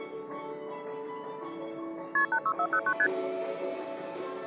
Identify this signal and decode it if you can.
Multi-frequency trunk signalling (R1, as on North American trunks), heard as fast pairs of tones, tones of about 70 ms, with the noise of a subway station. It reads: KP 86409 ST